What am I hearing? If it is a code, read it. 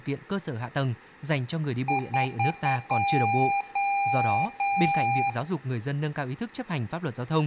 Beep code, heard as beeps from a small speaker, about 800 Hz, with room echo and speech in Vietnamese. 4 short, 3 long.